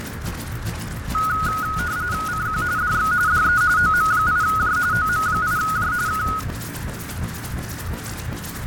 RTTY (45.45 baud, 170 Hz shift), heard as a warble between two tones, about 1360 Hz centre, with radio static, fading and a narrow filter. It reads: CQ DX DE OM8J OM8J K